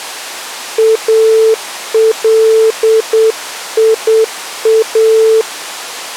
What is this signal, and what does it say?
Morse code, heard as a keyed tone, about 8 wpm, 440 Hz. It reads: ALIA